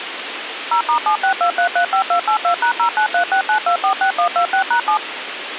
DTMF, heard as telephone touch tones, dialled by machine, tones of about 90 ms, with radio hiss. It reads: 0*762335282#09369246126#7